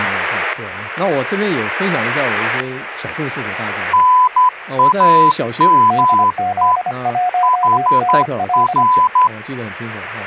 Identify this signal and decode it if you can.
Morse code, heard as two keyed tones, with static crashes and speech in Chinese. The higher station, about 11 wpm, 1000 Hz: NAME HR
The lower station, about 25 wpm, 720 Hz: DZ1NL